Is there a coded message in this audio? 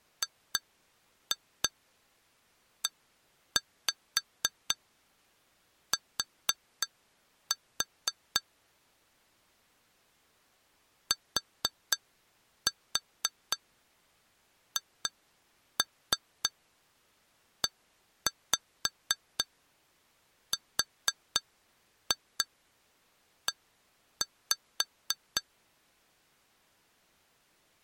Yes: tap code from 0.2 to 25.4 s, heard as taps on glass, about 4 knocks a second. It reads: GET THERE